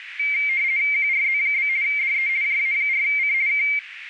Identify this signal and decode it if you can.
RTTY (50 baud, 170 Hz shift), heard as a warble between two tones, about 2200 Hz centre, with radio static and a narrow filter. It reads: QRZ? DE JA4C K